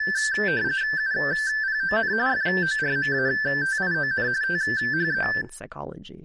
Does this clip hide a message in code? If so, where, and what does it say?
Yes: RTTY (45.45 baud, 170 Hz shift) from 0.0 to 5.4 s, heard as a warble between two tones, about 1650 Hz centre, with speech in English. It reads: UPON FORMATION THE